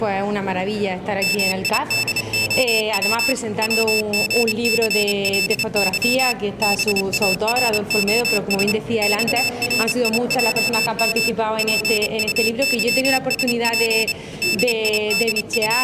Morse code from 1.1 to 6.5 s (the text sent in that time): MIDOW WGCLY